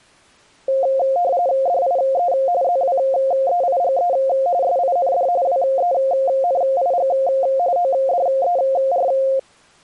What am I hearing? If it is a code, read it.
RTTY (45.45 baud, 170 Hz shift), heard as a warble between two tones, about 620 Hz centre. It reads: DIE ZWEIGE SIND WENIG ODER